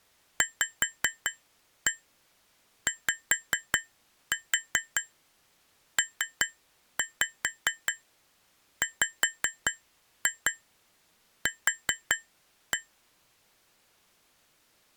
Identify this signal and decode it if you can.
Tap code, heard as taps on glass, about 5 knocks a second. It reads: VYPWQ